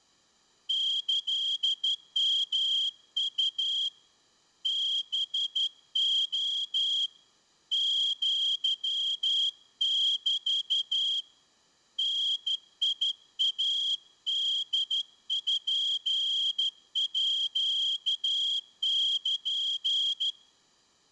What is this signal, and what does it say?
Morse code (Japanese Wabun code), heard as a whistle, hand-sent with a straight key, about 12 wpm, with room echo. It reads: キヨウ ハレ アメ ダイポール